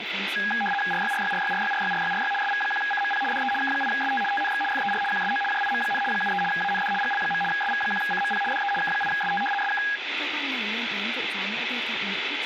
RTTY (75 baud, 850 Hz shift), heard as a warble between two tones, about 1230 Hz centre, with radio static and speech in Vietnamese. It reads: RYRYRYRYRYRYRY SV1CMP DE K8ST TNX FER QSO JIM, 73 AND GL. SV1CMP DE K8ST SK